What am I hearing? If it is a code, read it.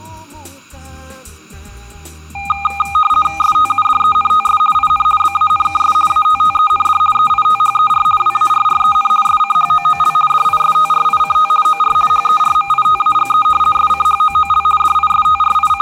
RTTY (50 baud, 450 Hz shift), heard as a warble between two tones, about 1020 Hz centre. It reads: STUDENTS IN BANKS ATTEND EITHER WARREN SCHOOL DISTRICT OR HERMITAGE SCHOOL …